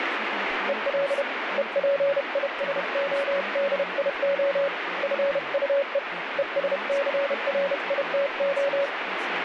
Morse code, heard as a keyed tone, hand-sent with a paddle, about 31 wpm, 560 Hz, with radio static and speech in English. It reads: EL EPISODIO FUE ESCRITO